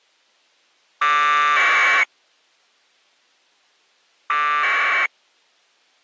Packet radio (AX.25, as in APRS), 1200 baud, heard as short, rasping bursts.